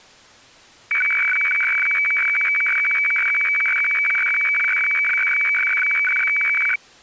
Weather fax (radiofax), 120 lines a minute, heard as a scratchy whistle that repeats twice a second.